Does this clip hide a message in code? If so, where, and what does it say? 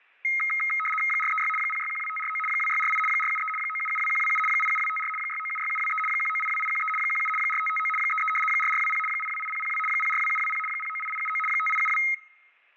Yes: RTTY (75 baud, 850 Hz shift) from 0.2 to 12.1 s, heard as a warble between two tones, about 1700 Hz centre. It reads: 436 0612549 2648 473 9772127 87254 6976723 1982813 17 4559 33 4420 828002 042720 098879 5872